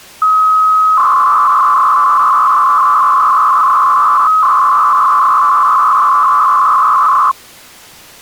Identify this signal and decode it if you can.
300-baud modem data (Bell 103 tones), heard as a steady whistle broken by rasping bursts, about 300 baud, 200 Hz shift.